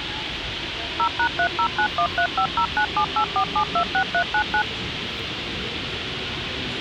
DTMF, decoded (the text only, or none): 0#30913509784726399